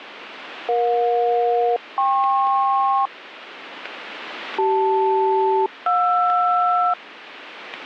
Aircraft SELCAL, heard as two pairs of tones, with radio static. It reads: EJ-KP CL-JR